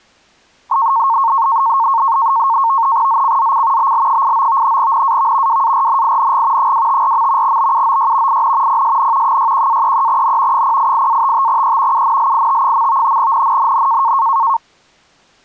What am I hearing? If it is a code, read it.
NAVTEX (SITOR-B), 100 baud, 170 Hz shift, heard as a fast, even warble, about 1000 Hz centre. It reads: ZCZC BL89 NAV WARNING 254. BUOY IN PSN 61-33N 088-55E UNLIT. NNNN